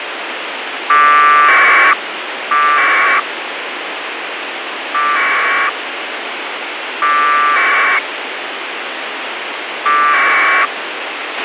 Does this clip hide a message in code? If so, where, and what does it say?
Yes: packet radio (AX.25, as in APRS), 1200 baud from 0.9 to 10.7 s, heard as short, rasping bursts, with radio hiss and a squelch burst at the end.